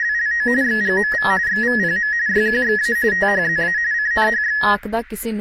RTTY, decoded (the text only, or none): … XGMV XVPM YQXA THZA CNHX